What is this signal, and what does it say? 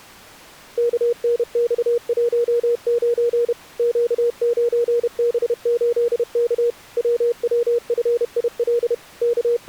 Morse code, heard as a keyed tone, machine-sent, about 31 wpm, 470 Hz. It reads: KNX19 Q9B8K WWFIL …